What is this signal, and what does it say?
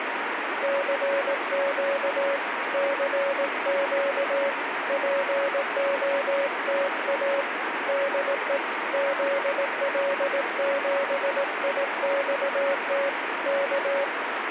Morse code, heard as a keyed tone, hand-sent with a paddle, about 18 wpm, 560 Hz, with radio static. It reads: CQ CQ POTA DE ZL7IXT K